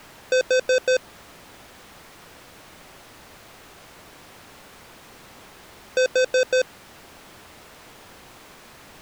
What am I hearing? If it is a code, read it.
Alarm pattern, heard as an alarm's beeps, played twice, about 510 Hz. Temporal four. Carbon monoxide.